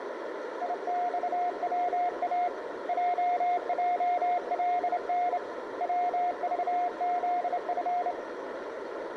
Morse code, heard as a keyed tone, hand-sent with a straight key, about 28 wpm, 710 Hz, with radio static and a narrow filter. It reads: IXWA JJLN WVZF